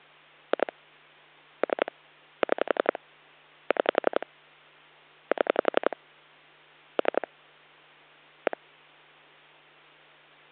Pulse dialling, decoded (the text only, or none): 2 3 6 6 7 3 1